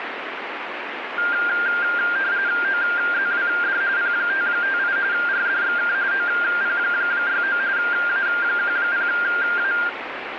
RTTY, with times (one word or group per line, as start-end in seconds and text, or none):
2.6-3.8 OZWD
4.0-5.0 P558
5.1-5.9 RDXK
6.1-7.6 OP69
7.8-9.7 A10A